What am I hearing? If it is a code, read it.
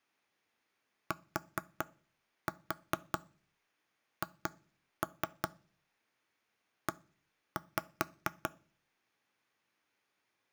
Tap code, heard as knocks on wood, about 4 knocks a second. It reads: THE